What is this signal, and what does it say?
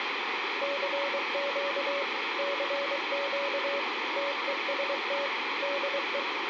Morse code, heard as a keyed tone, machine-sent, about 23 wpm, 560 Hz, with radio static and room echo. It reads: CQ CQ TEST DE